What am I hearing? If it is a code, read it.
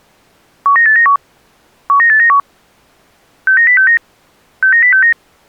Five-tone selective call (CCIR), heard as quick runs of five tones, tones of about 100 ms. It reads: 19891 19891 69069 69069